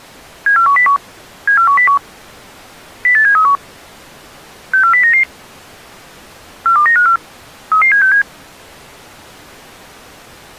Five-tone selective call (CCIR), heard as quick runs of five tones, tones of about 100 ms. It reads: 74101 74101 08731 64099 42954 33767